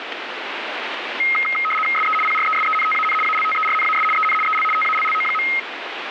RTTY (75 baud, 850 Hz shift), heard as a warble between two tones, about 1700 Hz centre, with radio static. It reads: SE PRESENTAN ALTERNAS EN EL TALLO.